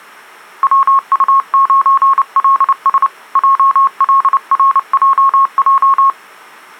Morse code, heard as a keyed tone, hand-sent with a paddle, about 29 wpm, 1090 Hz. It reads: WU9LS JLRJJ